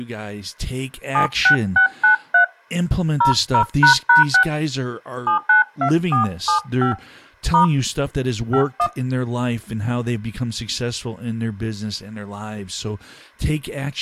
DTMF, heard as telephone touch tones, dialled by hand, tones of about 110 ms, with speech in English. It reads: 76693 00##6 792475 * 51